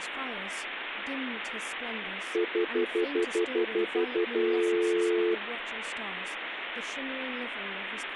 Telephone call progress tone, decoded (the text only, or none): stutter dial tone